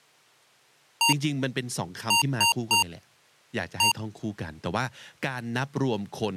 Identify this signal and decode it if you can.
Beep code, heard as beeps from a small speaker, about 930 Hz, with speech in English. 1-3-1. In Phoenix BIOS tables: memory refresh failure.